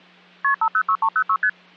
Multi-frequency trunk signalling (R1, as on North American trunks), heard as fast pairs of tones, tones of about 70 ms, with hum. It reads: KP 506306 ST